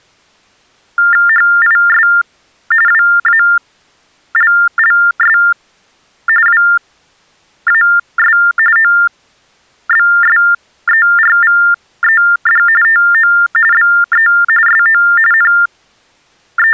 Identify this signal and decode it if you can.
TTY/TDD text telephone tones (45.45 baud Baudot), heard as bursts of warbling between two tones, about 400 Hz shift, 1600 Hz centre. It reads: HIS WALLS WAS OBSERVED TO BE SO …